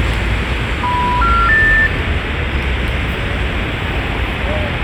Telephone call progress tone (North American plan), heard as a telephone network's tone, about 980, 1370, 1800 Hz, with phone line noise and the noise of a residential street. Special information tone.